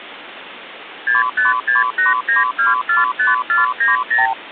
Multi-frequency trunk signalling (R2, with the far end's replies), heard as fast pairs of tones, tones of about 150 ms, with phone line noise. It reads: 65689245490